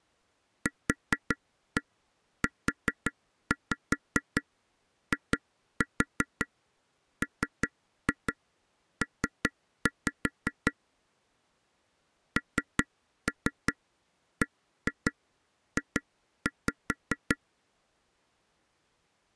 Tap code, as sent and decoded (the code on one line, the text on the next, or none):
4-1 4-5 2-4 3-2 3-5 / 3-3 1-2 2-5
QUIMP NBJ